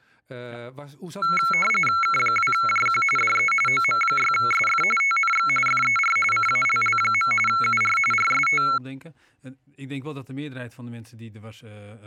RTTY (45.45 baud, 850 Hz shift), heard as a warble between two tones, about 1800 Hz centre. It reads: K2JQ DE OM6SF TNX FER CALL. UR RST